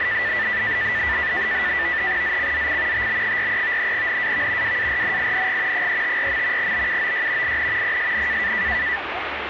NAVTEX (SITOR-B), 100 baud, 170 Hz shift, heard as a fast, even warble, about 1850 Hz centre, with radio static and the noise of a park. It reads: ZCZC TB43 NAV WARNING 354. BUOY IN PSN